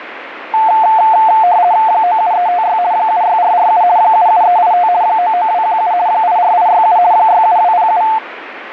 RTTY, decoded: 97356 76447 77385 99217 84867 67207

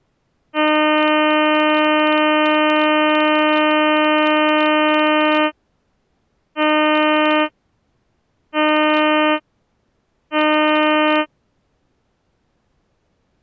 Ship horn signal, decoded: 1 long, 3 short

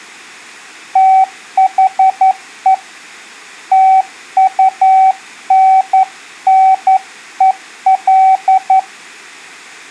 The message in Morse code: THE TUNNEL

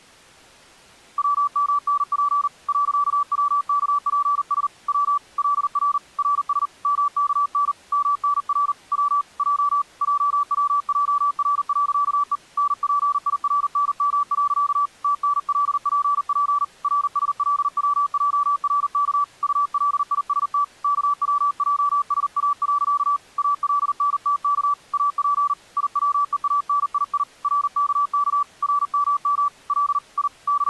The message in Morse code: WMNP .WKPS W LR RS MKN MNR W J JWJR.E NPIRNM. TNLPP RSLWJRK ULIST KWJSA. ALNTK AP IWEANII RKK RMM L I …

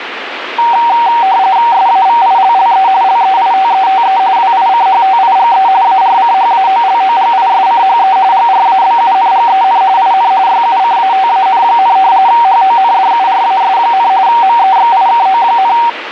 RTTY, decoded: SAVILLE LEITETE WICHTIGE ARCHAOLOGISCHE GRABUNGEN IN YUCATAN, HONDURAS, MEXIKO,

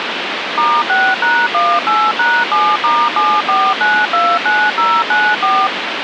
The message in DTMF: *6#18#7*74929094

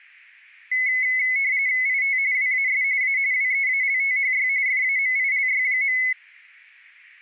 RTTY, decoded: IT WAS A WEALTHY FAMILY.

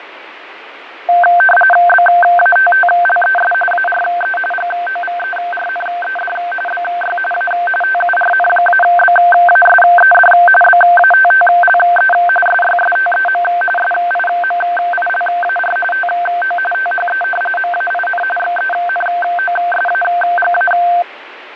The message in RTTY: BATTLES ARE GOVERNED BY A TURN-BASED BATTLE SYSTEM SIMILAR TO THE MAIN XENOSAGA

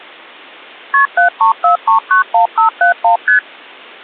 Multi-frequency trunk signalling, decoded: KP 734391571 ST

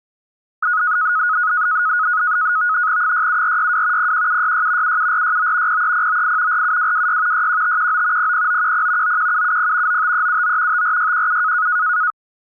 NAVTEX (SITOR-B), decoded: 67462 01766 77469 03098 47226 61519 00910 91770 95379 54617

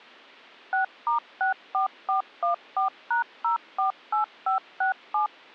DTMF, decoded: 6*64414#048567

